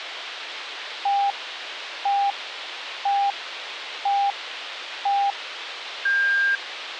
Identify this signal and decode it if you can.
Radio time signal (five pips and a higher one, as on Chinese radio), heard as pips, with radio hiss.